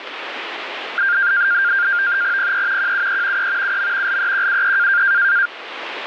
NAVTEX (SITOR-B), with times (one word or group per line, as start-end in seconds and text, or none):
2.4-2.9 PE
2.8-3.5 QUE
3.4-3.8 E
3.6-4.2 UM
4.1-5.0 LEQUE